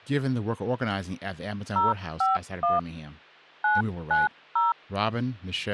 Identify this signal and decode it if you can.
DTMF, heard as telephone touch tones, dialled by hand, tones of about 170 ms, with hum and speech in English. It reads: 051 990